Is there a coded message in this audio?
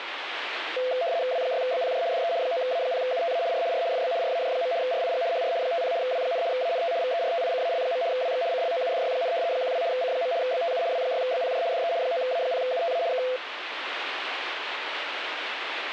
Yes: RTTY (75 baud, 170 Hz shift) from 0.8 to 13.4 s, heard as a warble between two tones, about 590 Hz centre, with radio static. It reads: W6BPJ DE 9A0UTA R R FB RAJ. RIG HR 50 W, ANT VERTICAL. WX CLOUDY, 12 C. BTU W6BPJ DE 9A0UTA K